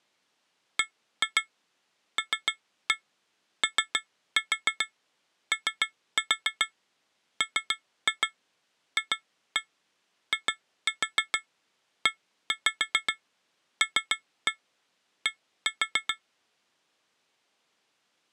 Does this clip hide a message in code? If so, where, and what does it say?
Yes: tap code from 0.8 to 16.2 s, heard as taps on glass, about 6 knocks a second. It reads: BLOOMFIELD